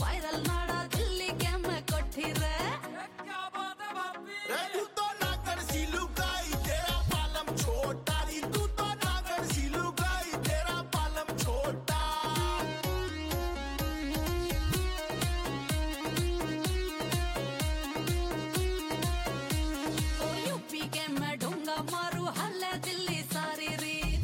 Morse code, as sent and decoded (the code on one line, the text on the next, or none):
none